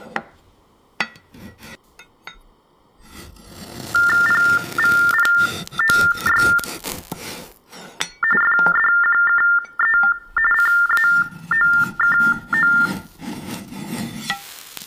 TTY/TDD text telephone tones (45.45 baud Baudot), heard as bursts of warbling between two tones, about 400 Hz shift, 1600 Hz centre. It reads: PVPOY FDQKE CAOKO